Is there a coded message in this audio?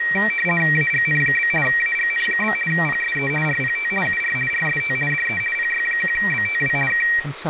Yes: RTTY (50 baud, 450 Hz shift) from 0.0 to 7.2 s, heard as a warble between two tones, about 2100 Hz centre, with radio static and speech in English. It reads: AGN? AGN? PSE RPT UR RST DE PY1BTW K